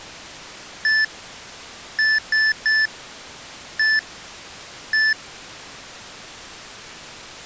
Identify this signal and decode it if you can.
Beep code, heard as beeps from a small speaker, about 1750 Hz. 1-3-1-1. In Phoenix BIOS tables: memory refresh test failure.